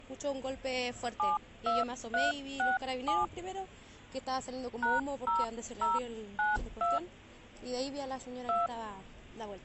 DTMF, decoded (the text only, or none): 72367 #0092 2